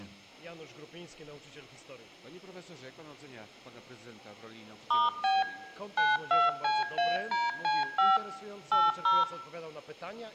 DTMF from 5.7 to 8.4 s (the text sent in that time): 92CADC5